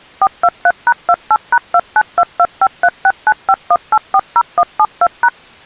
DTMF, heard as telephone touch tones, dialled by machine, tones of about 60 ms. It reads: 423#28#2922536951840172#